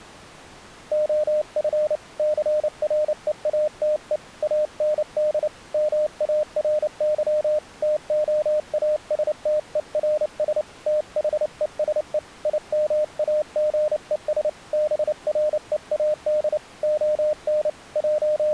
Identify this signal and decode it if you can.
Morse code, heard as a keyed tone, hand-sent with a paddle, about 29 wpm, 610 Hz. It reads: OF CREATE AND MARY TOASTERS THESE IMAGES BREAD ON …